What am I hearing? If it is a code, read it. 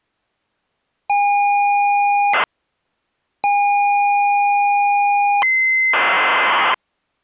ZX Spectrum tape loading, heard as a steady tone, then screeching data.